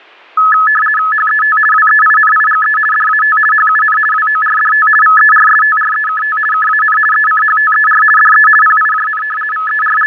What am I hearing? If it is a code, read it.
RTTY (50 baud, 450 Hz shift), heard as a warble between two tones, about 1500 Hz centre. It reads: HET WEINIGE DAT HUN WORDT VERSTREKT KAN ECHTER DE PIJN …